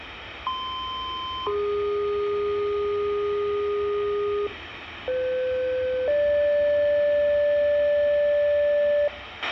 Two-tone page, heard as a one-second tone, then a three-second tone, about 1040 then 410 Hz, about 510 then 580 Hz, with a squelch burst at the end and the noise of a subway station.